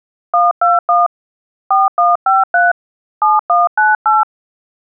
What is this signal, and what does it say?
DTMF, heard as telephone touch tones, dialled by hand, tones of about 180 ms. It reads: 121 4153 7198